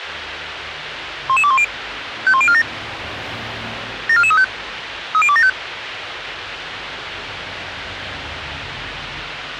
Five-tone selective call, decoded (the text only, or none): 11210 51047 74435 30275